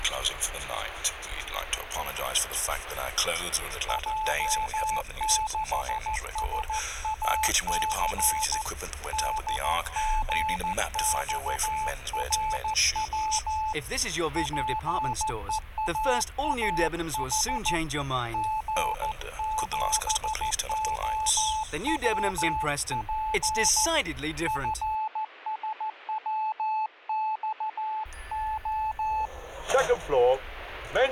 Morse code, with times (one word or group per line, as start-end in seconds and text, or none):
3.9-8.6 J6SAC
9.1-13.7 DGXRW
14.4-17.8 PEAAH
18.3-23.9 G7OWP
24.5-29.3 FSWXO